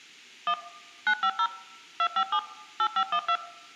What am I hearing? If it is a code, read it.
DTMF, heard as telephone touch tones, dialled by machine, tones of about 70 ms. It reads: 1 950 257 8512